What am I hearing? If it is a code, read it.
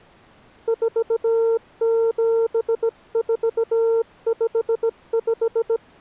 Morse code, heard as a keyed tone, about 17 wpm, 460 Hz. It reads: 47455